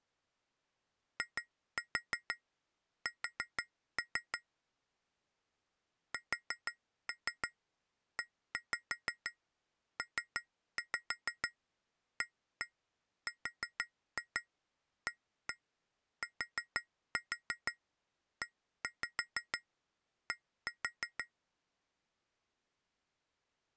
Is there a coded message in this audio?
Yes: tap code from 1.2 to 21.3 s, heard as taps on glass, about 6 knocks a second. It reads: IS SEPARATED